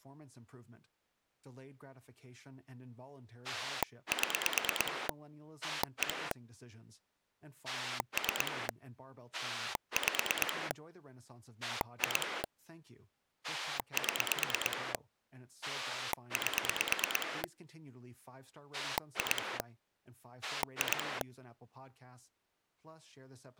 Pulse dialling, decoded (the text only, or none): 7 1 3 5 2 7 8 2 2